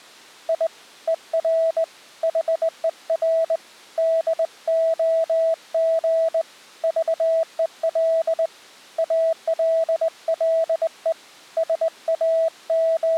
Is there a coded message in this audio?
Yes: Morse code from 0.4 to 13.2 s, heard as a keyed tone, hand-sent with a straight key, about 20 wpm, 650 Hz. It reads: I ER HER DOG VEL ALLE …